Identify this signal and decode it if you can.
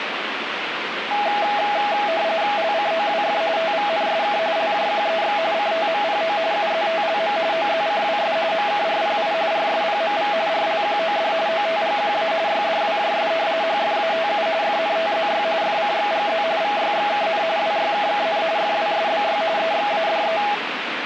RTTY (45.45 baud, 170 Hz shift), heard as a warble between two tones, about 740 Hz centre, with radio static. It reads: LCOWF TVNSK LJQEX CTMPO UZTLM OZCWS MKRPI RSPMV RLQOD OTGQA YDWJS HFATU FNTZY FCXGZ VYXKN WYKKN FWSBY EXADE